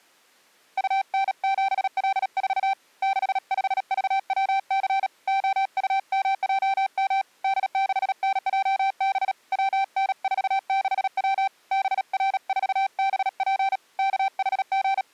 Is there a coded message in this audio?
Yes: Morse code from 0.7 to 15.1 s, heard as a keyed tone, hand-sent with a bug key, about 37 wpm, 780 Hz. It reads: UN7L4 65VWC OUMJM D6NJB WN46W BR4BP …